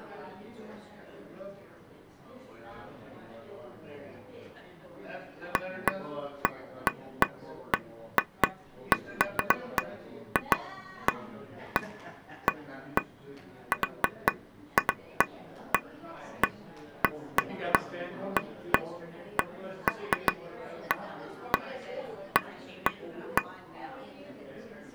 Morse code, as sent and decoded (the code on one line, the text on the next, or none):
none